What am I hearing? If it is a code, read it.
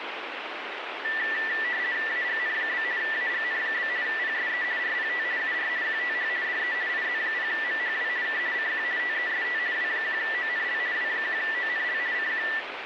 RTTY (50 baud, 170 Hz shift), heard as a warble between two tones, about 1850 Hz centre, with radio static. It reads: AGN? AGN? PSE RPT UR QTH DE IZ0MHW K CQ TEST W1ONL W1ONL CQ